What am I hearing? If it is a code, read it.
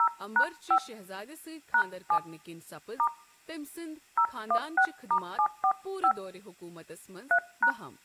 DTMF, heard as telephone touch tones, dialled by hand, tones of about 80 ms, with speech in Kashmiri. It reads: 0#5 #7 * 016*745 3#